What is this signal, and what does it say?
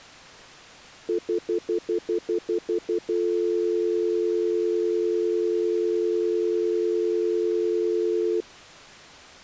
Telephone call progress tone (North American plan), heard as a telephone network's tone, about 350, 440 Hz, 0.1 s on and 0.1 s off. Stutter dial tone.